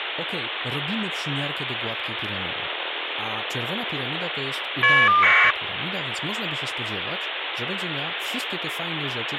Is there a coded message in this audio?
Yes: caller ID data burst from 2.3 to 5.5 s, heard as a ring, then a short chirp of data, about 1200 baud, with phone line noise and speech in Polish.